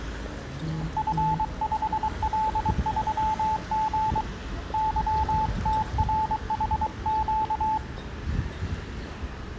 Morse code, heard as a keyed tone, hand-sent with a paddle, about 23 wpm, 870 Hz, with the noise of a residential street. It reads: F5L3G YTRHQ